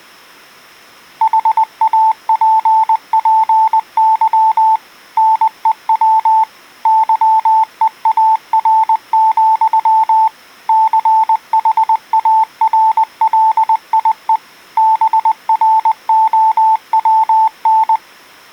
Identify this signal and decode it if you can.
Morse code, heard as a keyed tone, machine-sent, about 20 wpm, 880 Hz. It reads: HAPPY NEW YEAR, CHARLIE BROWN